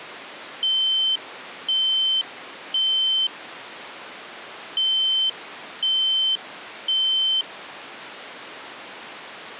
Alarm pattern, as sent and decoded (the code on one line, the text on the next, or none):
3 beeps and a pause
temporal three